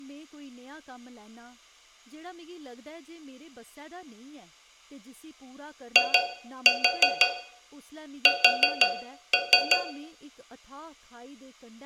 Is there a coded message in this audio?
Yes: tap code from 6.0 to 9.9 s, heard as taps on a metal pipe, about 5 knocks a second, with room echo and speech in Dogri. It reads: IS